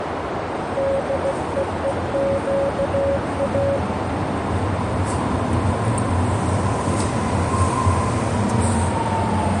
Morse code (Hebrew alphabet), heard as a keyed tone, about 16 wpm, 550 Hz, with heavy radio static, a narrow filter and the noise of a subway station. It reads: דווקא